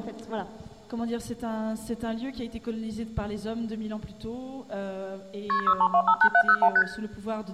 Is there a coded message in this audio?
Yes: multi-frequency trunk signalling (R1, as on North American trunks) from 5.5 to 6.8 s, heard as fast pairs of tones, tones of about 70 ms, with room echo. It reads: KP 63258701 ST